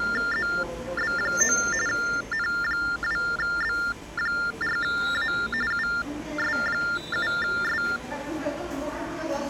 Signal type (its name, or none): TTY/TDD text telephone tones